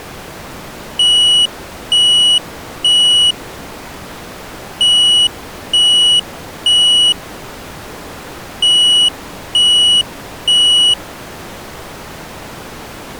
Alarm pattern, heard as an alarm's beeps, played three times, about 2950 Hz. Temporal three. Smoke or fire, evacuate.